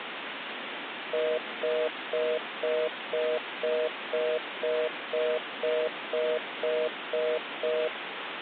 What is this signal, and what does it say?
Telephone call progress tone (North American plan), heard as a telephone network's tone, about 480, 620 Hz, 0.25 s on and 0.25 s off, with phone line noise. Congestion tone.